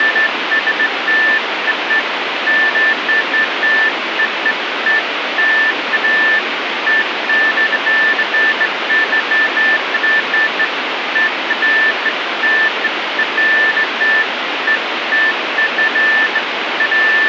Beeps of irregular length, with radio static. There is no code.